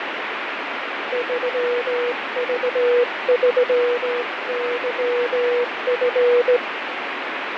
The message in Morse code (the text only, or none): 3V3YF